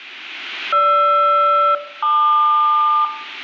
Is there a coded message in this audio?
Yes: aircraft SELCAL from 0.7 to 3.0 s, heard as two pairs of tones, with room echo. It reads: GR-LQ